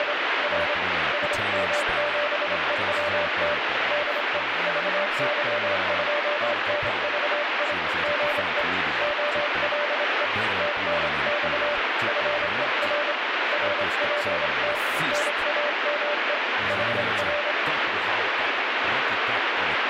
Morse code, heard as a keyed tone, hand-sent with a straight key, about 26 wpm, 590 Hz, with heavy radio static and speech in Finnish. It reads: … R SM7EWT DE VY2NVI GE OLE TNX FER RPT NAME HR